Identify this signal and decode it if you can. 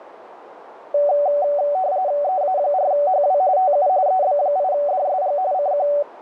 RTTY (45.45 baud, 170 Hz shift), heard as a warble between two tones, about 660 Hz centre, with radio static. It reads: EA4HW TU EB8DSG CQ